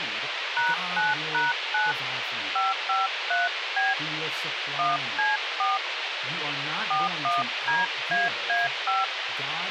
DTMF, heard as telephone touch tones, dialled by hand, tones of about 170 ms, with radio hiss, a squelch burst at the end and speech in English. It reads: #9#9 553B 1C4 41DAA5